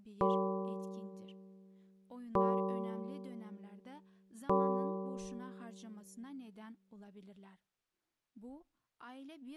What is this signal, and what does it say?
Clock strike, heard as a bell, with speech in Turkish. 3. Three o'clock.